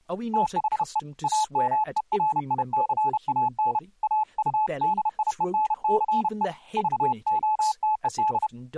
Morse code, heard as a keyed tone, hand-sent with a paddle, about 31 wpm, 860 Hz, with speech in English. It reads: THE AMERICAN AUDIENCE VOTED